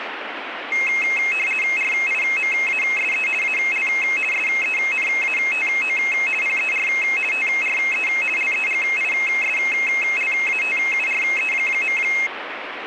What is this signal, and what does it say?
RTTY (50 baud, 450 Hz shift), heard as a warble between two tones, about 2350 Hz centre, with radio static. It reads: RIMASE AL SENATO PER TRE LEGISLATURE.